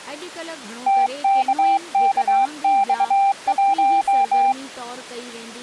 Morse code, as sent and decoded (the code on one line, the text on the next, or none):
- -.- -.- -..- .----
TKKX1